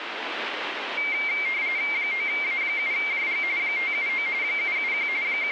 RTTY (45.45 baud, 170 Hz shift), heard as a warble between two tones, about 2200 Hz centre, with radio static. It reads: 9A7JG 579 771 …